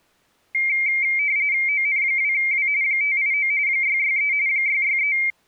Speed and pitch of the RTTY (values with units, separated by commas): 45.45 baud, 170 Hz shift, 2200 Hz centre